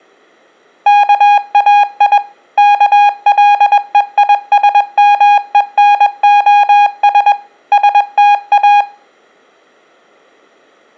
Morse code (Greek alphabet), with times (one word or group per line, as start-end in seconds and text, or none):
0.9-2.2 ΚΑΙ
2.6-7.3 ΚΛΕΙΣΜΕΝΟΣ
7.7-8.8 ΣΤΑ